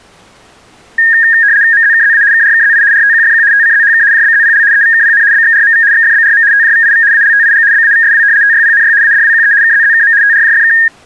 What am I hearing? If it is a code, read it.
RTTY (75 baud, 170 Hz shift), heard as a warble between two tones, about 1750 Hz centre. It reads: MZKZA KRKZI RTQFQ TCZHK JBZPL EVKPN BXRMV XFBRM TJVIV ALTIG BAVSW TYPNY ADWQE KZZKM TRJFK